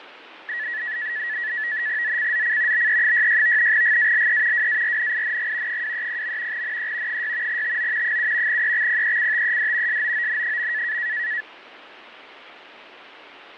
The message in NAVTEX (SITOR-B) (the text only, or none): ZCZC BE66 GALE WARNING 230. NE 6 TO 7 EXPECTED SOON.